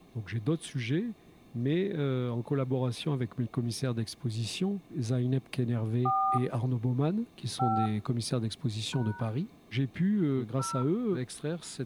DTMF, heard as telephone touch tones, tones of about 280 ms. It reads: 4 5 # 0